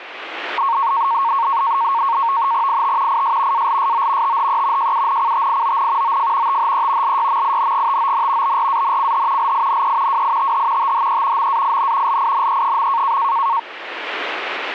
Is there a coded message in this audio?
Yes: NAVTEX (SITOR-B), 100 baud, 170 Hz shift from 0.6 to 13.6 s, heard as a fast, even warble, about 1010 Hz centre. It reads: IT IS ALSO THE JUNCTION OF THE LYMINGTON BRANCH LINE WITH THE MAIN LINE.